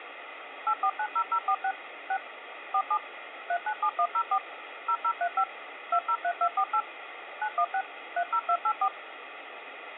DTMF, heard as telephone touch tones, dialled by machine, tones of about 70 ms, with phone line noise. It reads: 8490046 6 47 397104 0035 203248 916 30284